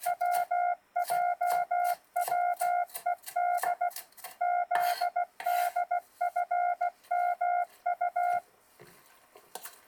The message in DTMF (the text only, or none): none